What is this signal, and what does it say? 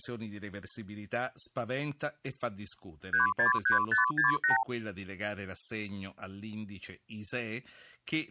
Multi-frequency trunk signalling (R2, with the far end's replies), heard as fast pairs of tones, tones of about 130 ms, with speech in Italian. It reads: 363568